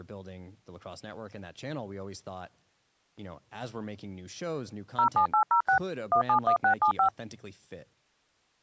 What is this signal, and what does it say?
DTMF, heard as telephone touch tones, dialled by machine, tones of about 100 ms, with speech in English. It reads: 07806 171675